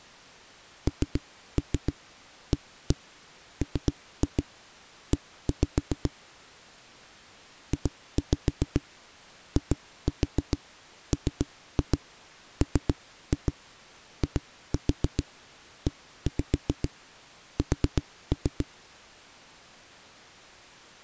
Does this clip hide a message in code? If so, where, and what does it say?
Yes: tap code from 0.9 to 18.7 s, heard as knocks on a wall, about 7 knocks a second. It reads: NAME JIMMIES